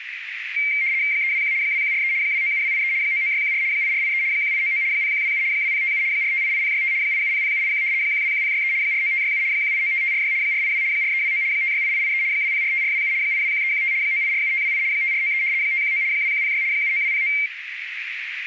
RTTY (75 baud, 170 Hz shift), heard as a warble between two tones, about 2200 Hz centre, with radio static and a narrow filter. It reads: 321 2143 297283 99614 8483 1899 0127 2057 4588065 8700781 121063 49567 1895546 482 4329 568883 2045427 821315 9847528 5493 519 2106 79209